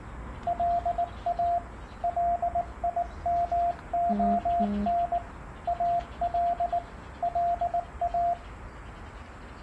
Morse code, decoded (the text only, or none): LA LIMON AL LA